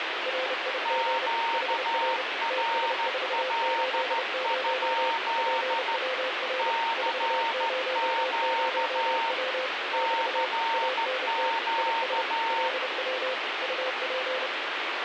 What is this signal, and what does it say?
Morse code, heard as two keyed tones, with radio static. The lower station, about 30 wpm, 520 Hz: RIG HR TS480 PWR 400W <BT> ANT IS LW UP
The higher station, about 14 wpm, 920 Hz: QRL? CQ CQ